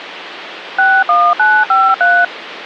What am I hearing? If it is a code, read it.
DTMF, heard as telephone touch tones, dialled by machine, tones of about 240 ms, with phone line noise. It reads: 61953